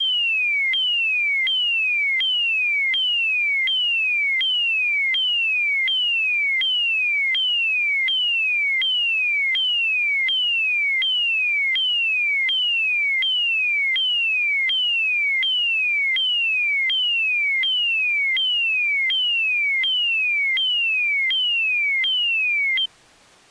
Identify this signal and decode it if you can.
A tone that sweeps in pitch again and again. There is no code.